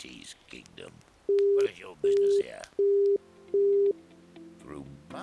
Telephone call progress tone (as in the UK, Australia and similar networks), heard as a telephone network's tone, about 400 Hz, 0.375 s on and 0.375 s off. Busy tone.